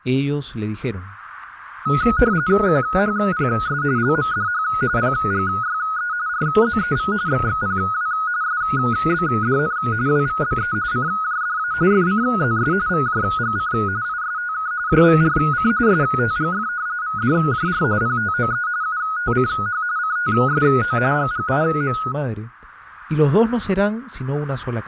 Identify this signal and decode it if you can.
RTTY (45.45 baud, 170 Hz shift), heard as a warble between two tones, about 1360 Hz centre, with static crashes. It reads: QHPS LMDH PGYE RZEV XXPW SBDN WVBE CJDA FCZS VJGC ISTK JVRC STGF VDJR PTOE UTCH CTSO GGIM